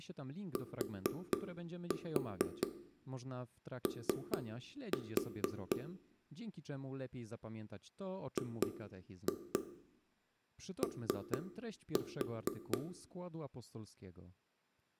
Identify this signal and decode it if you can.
Tap code, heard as taps on a table, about 4 knocks a second, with room echo and speech in Polish. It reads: TO GO